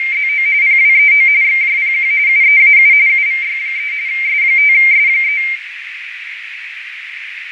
RTTY (45.45 baud, 170 Hz shift), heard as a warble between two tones, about 2200 Hz centre, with radio static, fading and a narrow filter. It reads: … PWEO XJPQ UEAU UVY3 S5S3